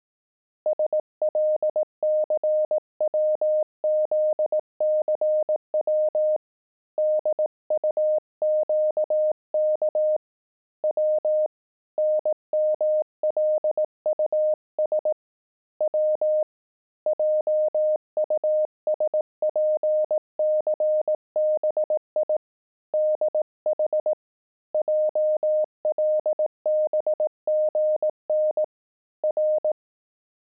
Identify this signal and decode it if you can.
Morse code, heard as a keyed tone, hand-sent with a paddle, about 18 wpm, 610 Hz. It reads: SLCWZCW DUQK W NMLUS W JUSPCBI DH JLBGN R